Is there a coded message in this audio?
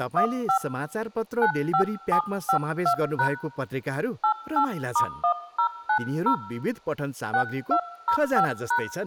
Yes: DTMF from 0.2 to 8.8 s, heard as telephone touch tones, dialled by hand, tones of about 90 ms, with speech in Nepali. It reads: 15 95752# 88*1090 6205#